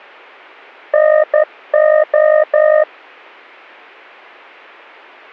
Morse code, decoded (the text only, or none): NO